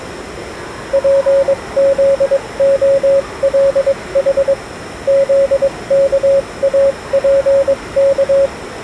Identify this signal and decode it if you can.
Morse code (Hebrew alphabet), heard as a keyed tone, machine-sent, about 22 wpm, spaced as for 19 wpm, 550 Hz, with the noise of a crowd indoors. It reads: פזהלח זכאפך